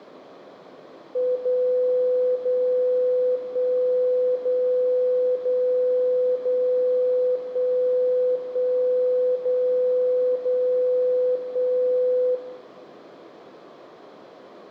Radio time signal (DCF77), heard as a tone whose level steps once a second, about 500 Hz, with radio static and room echo. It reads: 0 0 1 0 0 0 1 1 0 0 1